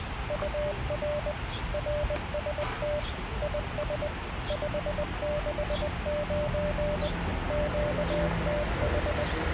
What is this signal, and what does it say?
Morse code, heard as a keyed tone, machine-sent, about 20 wpm, 590 Hz, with radio static and the noise of a residential street. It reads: UR RST IS 569 QTH